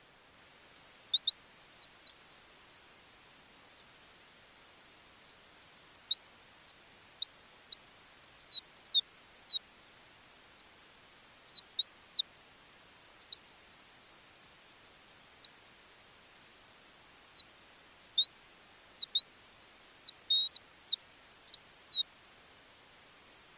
Bird-like chirps. There is no code.